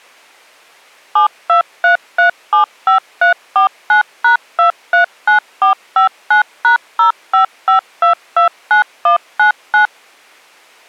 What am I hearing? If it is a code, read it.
DTMF, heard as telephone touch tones, dialled by machine, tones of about 120 ms. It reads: 723375349#239459#055229199